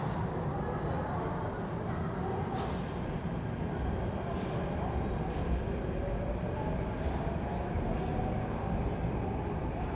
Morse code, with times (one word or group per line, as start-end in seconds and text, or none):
none